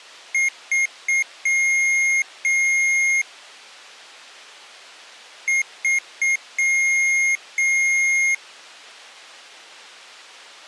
Beep code, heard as beeps from a small speaker, played twice, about 2150 Hz. 3 short, 2 long.